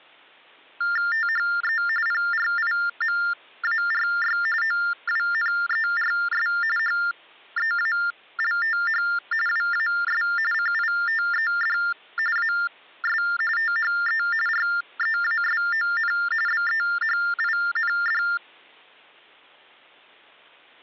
TTY/TDD text telephone tones (45.45 baud Baudot), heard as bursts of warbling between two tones, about 400 Hz shift, 1600 Hz centre. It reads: THE PRIMARY OWNERS HEALTH WAS CITED AS THE REASON BEHIND